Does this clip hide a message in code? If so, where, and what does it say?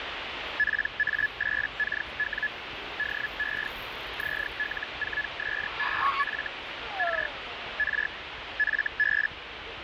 Yes: Hellschreiber (Feld-Hell, 122.5 baud) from 0.6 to 9.3 s, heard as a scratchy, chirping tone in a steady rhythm, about 1700 Hz, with radio static and the noise of a park. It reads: PA8KW DE ZL4SEF R R FB